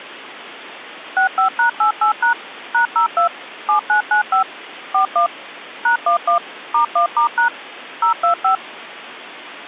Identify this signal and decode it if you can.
DTMF, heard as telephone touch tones, dialled by machine, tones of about 110 ms. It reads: 65#88# #02 7995 41 #11 *1*# 025